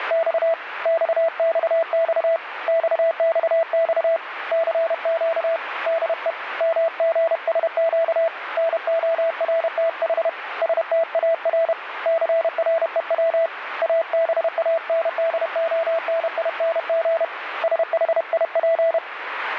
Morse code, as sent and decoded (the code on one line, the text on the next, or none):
… / -..- -..- -..- / -..- -..- -..- / -.-. --.- / -.. . / -- --. ... --.- / -. --- .-. - .... / ... - .- .-. / -.-. .-. . .-- / .- -... .- -. -.. --- -. .. -. --. / ... .... .. .--.
… XXX XXX CQ DE MGSQ NORTH STAR CREW ABANDONING SHIP